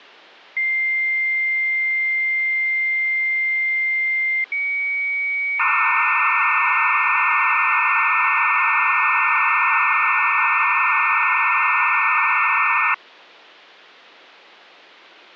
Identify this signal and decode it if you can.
Dial-up modem handshake (low-speed, two carriers), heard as two whistles, then hiss.